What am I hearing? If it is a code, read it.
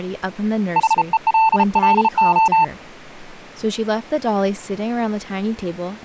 Morse code, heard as a keyed tone, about 33 wpm, 890 Hz, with speech in English. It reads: HELLO